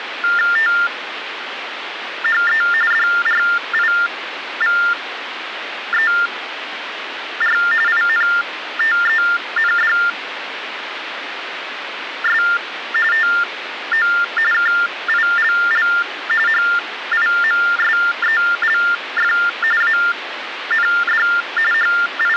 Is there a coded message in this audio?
Yes: TTY/TDD text telephone tones (45.45 baud Baudot) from 0.2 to 22.4 s, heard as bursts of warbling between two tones, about 400 Hz shift, 1600 Hz centre, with phone line noise. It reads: THE DRIVER INTENDS TO KILL HIMSELF AND …